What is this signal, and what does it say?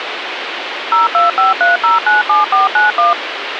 DTMF, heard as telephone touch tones, dialled by machine, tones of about 150 ms, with phone line noise. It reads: 0253097491